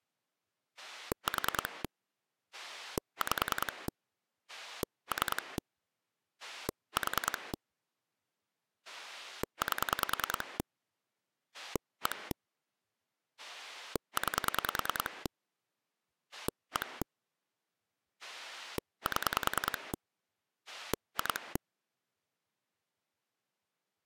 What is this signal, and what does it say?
Pulse dialling, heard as a rotary dial, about 10 pulses a second. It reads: 4 5 3 4 8 1 9 1 7 2